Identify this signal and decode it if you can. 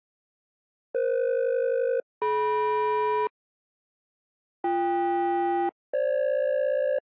Aircraft SELCAL, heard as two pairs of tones. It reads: EF-DM BK-FG